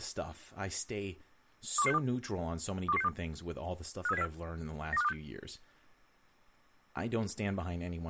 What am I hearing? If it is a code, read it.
Five-tone selective call (EEA), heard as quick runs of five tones, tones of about 40 ms, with speech in English. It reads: 21162 21162 53704 92526